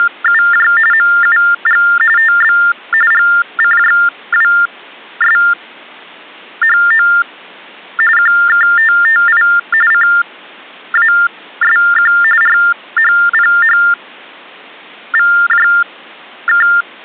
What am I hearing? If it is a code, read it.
TTY/TDD text telephone tones (45.45 baud Baudot), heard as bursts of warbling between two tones, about 400 Hz shift, 1600 Hz centre. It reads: … MUG TB GCJWSHO QKTTI CASQ RHPHVJK